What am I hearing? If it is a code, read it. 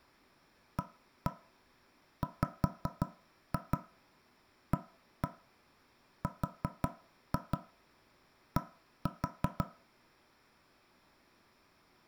Tap code, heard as knocks on wood, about 5 knocks a second, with room echo. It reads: AWARD